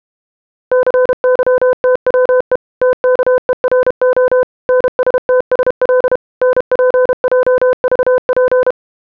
Morse code, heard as a keyed tone, machine-sent, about 32 wpm, 510 Hz. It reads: CYTWE TKERO NSTSL NPJVP